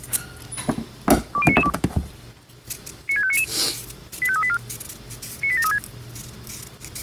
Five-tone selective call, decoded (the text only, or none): 20992 96599 85384 98736